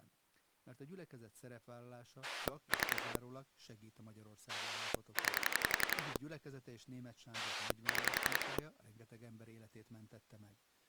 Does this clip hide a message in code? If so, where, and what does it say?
Yes: pulse dialling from 2.2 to 8.6 s, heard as a rotary dial, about 11 pulses a second, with speech in Hungarian. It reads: 3 9 6